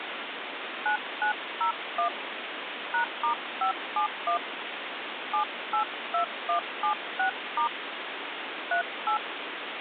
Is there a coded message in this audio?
Yes: DTMF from 0.9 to 9.2 s, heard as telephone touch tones, dialled by hand, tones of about 100 ms, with phone line noise. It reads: 9901 #*571 782176* 38